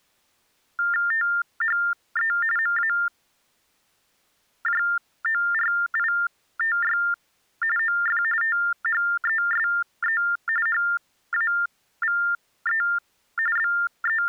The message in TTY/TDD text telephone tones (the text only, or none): THE MAJORITY OF THESE HAVE …